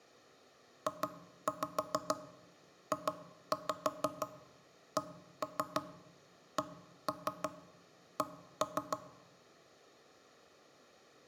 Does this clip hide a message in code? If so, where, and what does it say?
Yes: tap code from 0.9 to 9.0 s, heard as knocks on wood, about 6 knocks a second, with room echo. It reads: JJCCC